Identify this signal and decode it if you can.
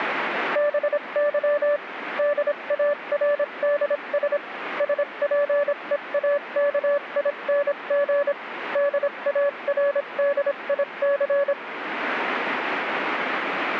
Morse code, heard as a keyed tone, machine-sent, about 26 wpm, spaced as for 23 wpm, 580 Hz, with radio static. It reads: BY DARDS SPEAKING DARDIC